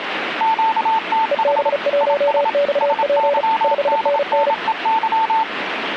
Morse code, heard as two keyed tones, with radio static. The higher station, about 27 wpm, 890 Hz: QTH IS SYDNEY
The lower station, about 35 wpm, 570 Hz: EB1XP 5NN